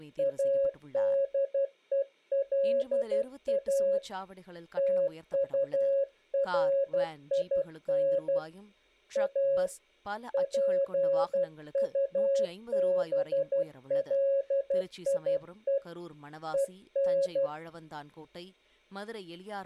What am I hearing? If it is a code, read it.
Morse code, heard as a keyed tone, hand-sent with a paddle, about 12 wpm, 550 Hz, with speech in Tamil. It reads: ADELA TURIN A PUBLIE EN